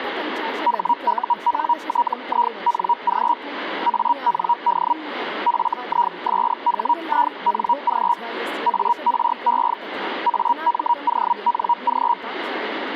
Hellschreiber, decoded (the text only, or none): HUNTING AND FISHING ARE AMONG